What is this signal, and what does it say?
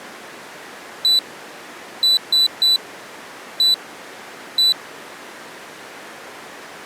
Beep code, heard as a piezo beeper, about 4000 Hz. 1-3-1-1. In Phoenix BIOS tables: memory refresh test failure.